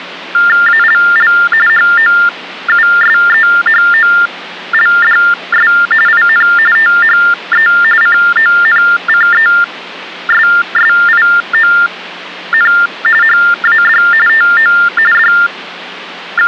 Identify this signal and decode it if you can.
TTY/TDD text telephone tones (45.45 baud Baudot), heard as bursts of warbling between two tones, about 400 Hz shift, 1600 Hz centre. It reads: ALL HOUSEHOLDS IN THE CONCESSION HAD TO …